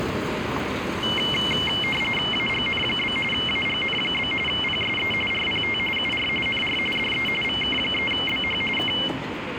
RTTY (45.45 baud, 850 Hz shift), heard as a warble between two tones, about 2550 Hz centre, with radio static and street noise. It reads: AGN? AGN? PSE RPT UR NR DE VK3BH K